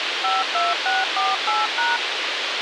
DTMF, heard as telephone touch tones, dialled by machine, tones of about 180 ms, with radio hiss. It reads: 52648#